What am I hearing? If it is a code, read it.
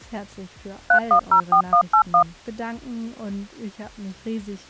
DTMF, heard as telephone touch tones, dialled by machine, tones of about 90 ms. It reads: 3104181